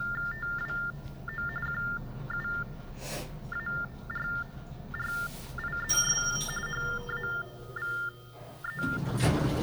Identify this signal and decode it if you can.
TTY/TDD text telephone tones (45.45 baud Baudot), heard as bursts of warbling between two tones, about 400 Hz shift, 1600 Hz centre, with the noise inside a lift. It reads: TWO QUARRIES HAVE